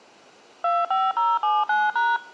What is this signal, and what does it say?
DTMF, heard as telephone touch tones, dialled by machine, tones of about 210 ms. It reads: 25079#